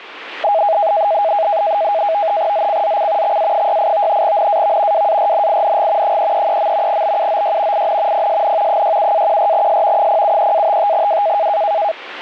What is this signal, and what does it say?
NAVTEX (SITOR-B), 100 baud, 170 Hz shift, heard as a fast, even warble, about 730 Hz centre. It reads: ZCZC XA68 NAV WARNING 333. BUOY IN PSN 67-14S 073-55W